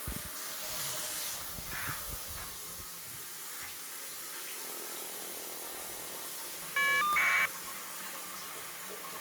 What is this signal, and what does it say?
Caller ID data burst, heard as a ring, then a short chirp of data, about 1200 baud, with the noise of a restroom.